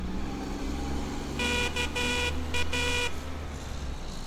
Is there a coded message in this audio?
Yes: Morse code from 1.3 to 3.1 s, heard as a buzzer, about 13 wpm, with street noise. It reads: KA